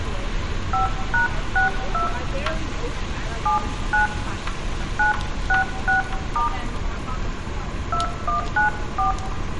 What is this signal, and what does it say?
DTMF, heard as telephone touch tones, dialled by hand, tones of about 120 ms, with room echo and street noise. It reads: 5#62 79 966* 2194